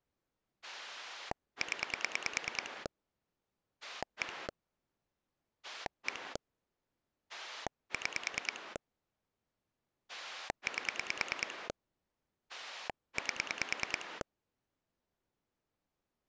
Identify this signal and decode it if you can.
Pulse dialling, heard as a rotary dial, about 9 pulses a second. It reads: 0 1 1 6 8 8